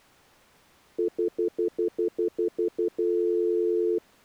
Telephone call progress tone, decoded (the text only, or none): stutter dial tone